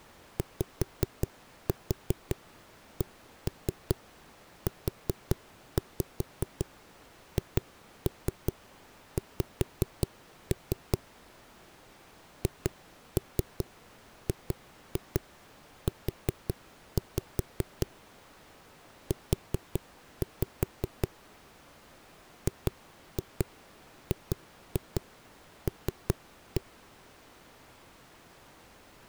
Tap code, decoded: YCUHX HGU U GGL

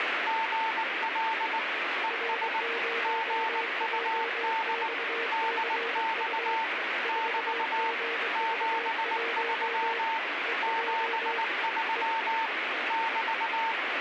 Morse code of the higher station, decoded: GL ES GUD DX <BT> 73 73 <BT>

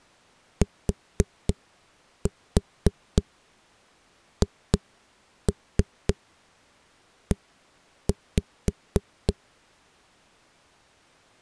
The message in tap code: THE

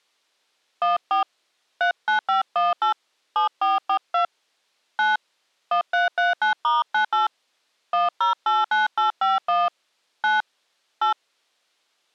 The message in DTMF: 14 39518 7442 9 1339*98 1089851 9 8

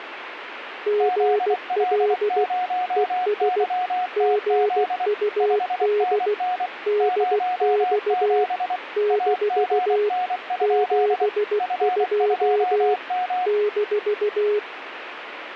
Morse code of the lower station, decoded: GL ES GUD DX - 72 -

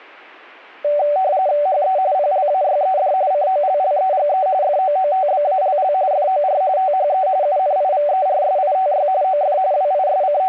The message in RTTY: HE PLAYED COLLEGE FOOTBALL FOR THE UNIVERSITY OF …

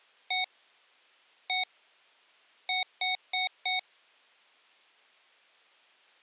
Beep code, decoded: 1-1-4

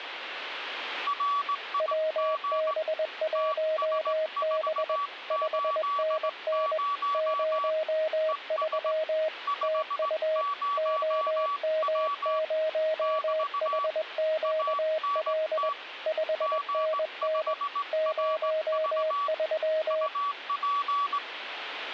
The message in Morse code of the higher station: RIG TS480 ES 50W <BT> ANT G5RV UP

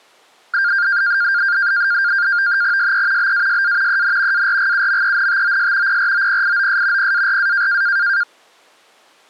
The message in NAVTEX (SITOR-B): SE BASA EN ARGUMENTOS PROPIOS PARA

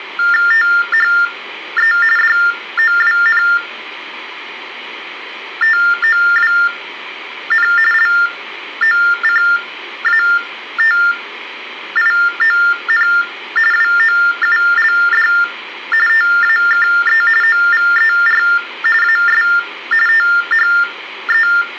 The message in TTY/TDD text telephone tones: THE DOWNTOWN LOCATION WOULD TAKE OVER AS THE

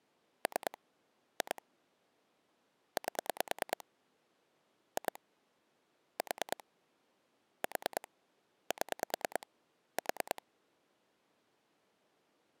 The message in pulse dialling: 3 2 8 2 4 4 7 4

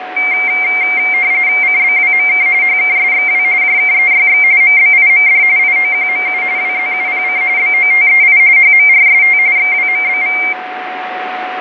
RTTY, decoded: CBWMK HKSXW JKEYX MBIMD IOQMU WZUPC BOTEI HMRST XWMBV

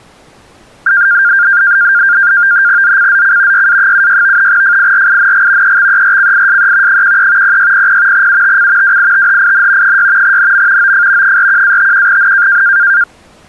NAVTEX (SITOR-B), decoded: ZCZC YA76 FIRING EXERCISE 13 0600 UTC WITHIN 6 NM OF 41-51N

